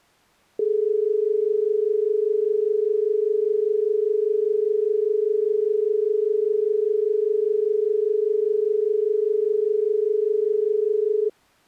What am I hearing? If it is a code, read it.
Telephone call progress tone (as in Australia), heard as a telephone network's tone, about 430 Hz. Dial tone.